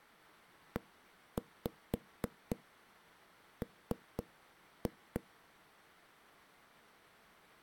Tap code, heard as knocks on a wall, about 4 knocks a second. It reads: EM